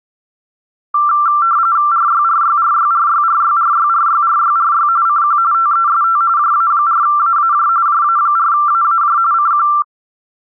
RTTY (45.45 baud, 170 Hz shift), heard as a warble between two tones, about 1260 Hz centre. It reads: RYRYRYRYRYRYRYRYRY CQ TEST JA4AAJ JA4AAJ CQ